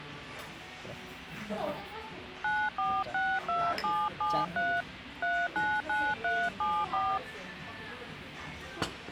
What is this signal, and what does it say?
DTMF, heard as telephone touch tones, dialled by hand, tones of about 240 ms, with phone line noise and the noise of a restaurant. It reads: 9462773 399374